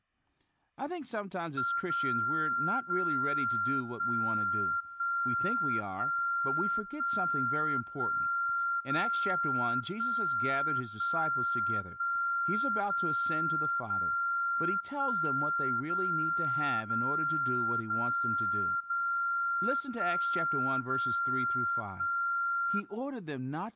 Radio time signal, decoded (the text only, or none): 0 0 1 1 1 1 1 0 1 1 1 0 0 1 0 0 0 0 1 0 1